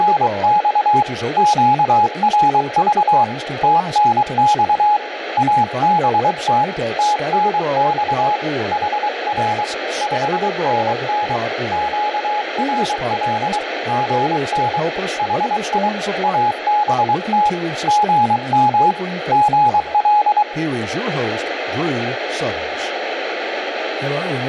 Morse code, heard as a keyed tone, hand-sent with a paddle, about 23 wpm, 840 Hz, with radio static and speech in English. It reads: … QRV TNX ABT TNX HR 5NN QRL GN HI ABT GM GL